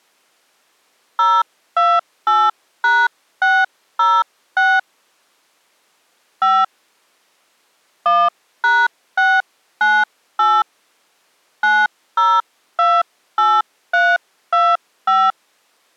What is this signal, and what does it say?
DTMF, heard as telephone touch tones, dialled by hand, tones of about 230 ms. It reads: 028#606 5 1#698 9028325